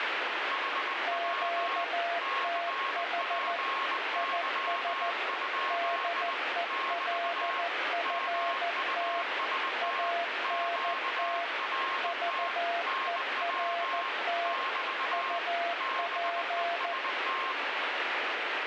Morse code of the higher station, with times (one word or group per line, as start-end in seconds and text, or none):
0.5-1.8 HW
2.2-6.3 CPY?
6.7-7.6 <BT>
8.0-10.1 MUST
10.4-12.5 QRT
12.9-14.1 NW
14.4-15.4 <BT>
15.8-17.5 BEST